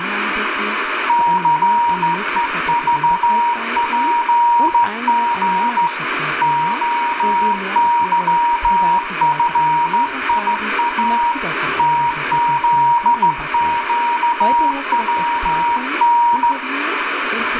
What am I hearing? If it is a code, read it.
Morse code, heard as a keyed tone, hand-sent with a straight key, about 14 wpm, 950 Hz, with radio static, room echo and speech in German. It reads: CEVPG OYFIA TZQWN